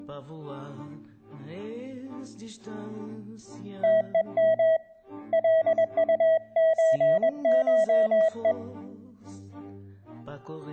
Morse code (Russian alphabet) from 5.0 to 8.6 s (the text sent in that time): ЛУЧШЕ